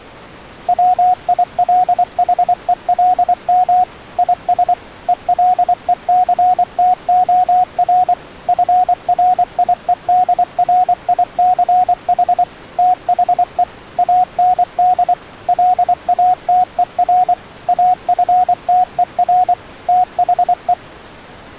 Morse code, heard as a keyed tone, machine-sent, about 24 wpm, 730 Hz. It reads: WILHELM IS ELECTOR FRIEDRICH THE AND LATER AFTER THE